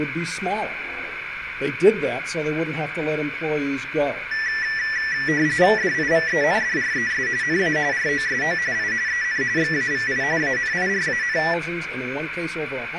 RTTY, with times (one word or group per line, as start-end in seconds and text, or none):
5.8-7.3 DIVENDRES
7.4-7.8 NA
7.9-8.6 ROSO
8.7-8.9 I
9.1-9.4 EN
9.6-10.2 XAVI
10.4-11.4 ANIRAN